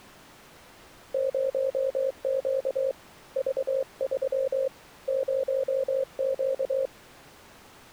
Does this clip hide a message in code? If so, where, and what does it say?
Yes: Morse code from 1.1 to 6.9 s, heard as a keyed tone, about 23 wpm, 530 Hz. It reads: 0Q V3 0Q